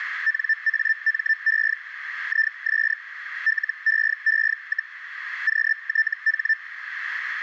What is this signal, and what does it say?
Hellschreiber (Feld-Hell, 122.5 baud), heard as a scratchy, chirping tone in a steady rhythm, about 1800 Hz, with radio static and a narrow filter. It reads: NAME IS LEE, QTH